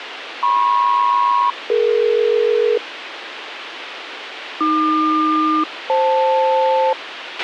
Aircraft SELCAL, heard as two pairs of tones, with radio hiss and a squelch burst at the end. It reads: MP-DE AQ-FL